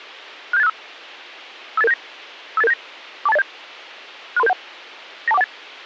Five-tone selective call (EIA), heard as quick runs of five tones, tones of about 30 ms, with a squelch burst at the end. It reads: 67865 58879 58879 42807 63371 92418